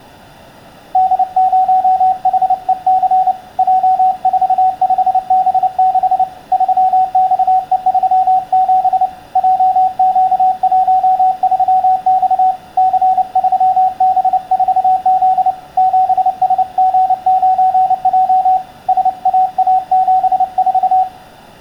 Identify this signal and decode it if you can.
Morse code, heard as a keyed tone, hand-sent with a paddle, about 29 wpm, 750 Hz, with room echo. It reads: D0HEC J45B6 3XE37 JQ13X C3B4Z 7SG9J SAA74